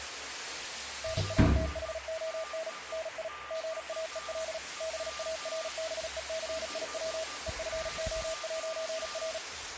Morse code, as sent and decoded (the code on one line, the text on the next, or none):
-. .- - .... --- -. / -. .. / --. .- . .-.. / -... .- .-. -... . -.-. .. .-- / . ..-. --- .----. .-.
NATHON NI GAEL BARBECIW EFO'R